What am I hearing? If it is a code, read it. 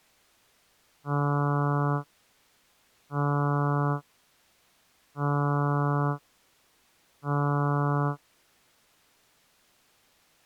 Ship horn signal, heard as a ship's horn, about 140 Hz. 4 short. At sea: a pilot vessel's identity signal in fog.